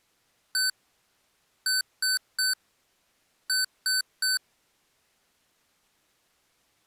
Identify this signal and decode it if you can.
Beep code, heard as beeps from a small speaker, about 1500 Hz. 1-3-3. In Phoenix BIOS tables: chip or data line failure in the first 64 KB of memory.